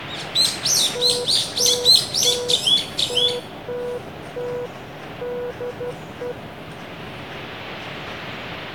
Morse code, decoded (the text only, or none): TTT TTT DE